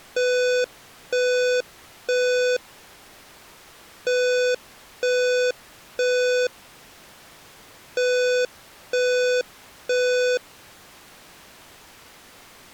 Alarm pattern, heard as an alarm's beeps, played three times, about 500 Hz. Temporal three. Smoke or fire, evacuate.